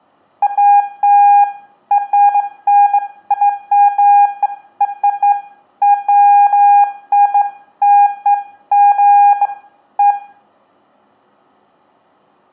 Beeps of irregular length, with room echo. There is no code.